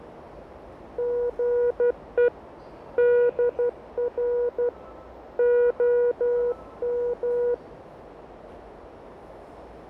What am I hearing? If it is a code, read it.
Morse code, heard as a keyed tone, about 12 wpm, 480 Hz, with radio static, fading and the noise of a subway station. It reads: GE DR OM